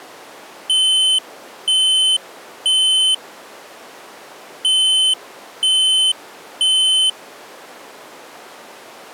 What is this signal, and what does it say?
Alarm pattern, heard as an alarm's beeps, played twice, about 3050 Hz. Temporal three. Smoke or fire, evacuate.